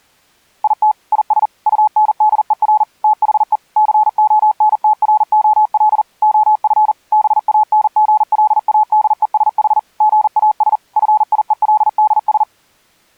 Morse code, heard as a keyed tone, machine-sent, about 40 wpm, 860 Hz. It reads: IT IS UNDER THE CONTROL OF BANGLADESH GAS FIELDS